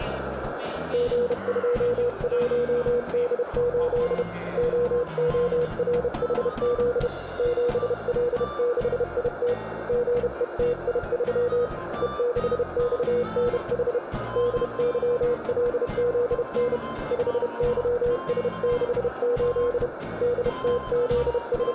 Morse code, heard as a keyed tone, hand-sent with a bug key, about 31 wpm, 480 Hz, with radio static and a narrow filter. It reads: G21D8 OORHZ 7L6IT GETI3 E6XNH DYLZN 5YS68 …